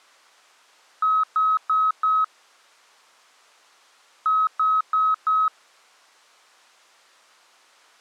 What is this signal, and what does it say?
Beep code, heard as beeps, played twice, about 1280 Hz. 4 short. In AMI BIOS tables: system timer failure; in Dell tables: memory read or write failure.